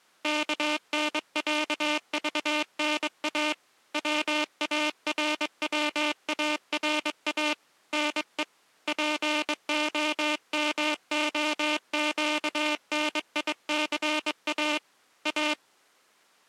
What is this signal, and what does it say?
Morse code (Russian alphabet), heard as a buzzer, hand-sent with a straight key, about 22 wpm. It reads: КНЯЖНА ВАРВАРА НЕ ПОМОЩНИЦА А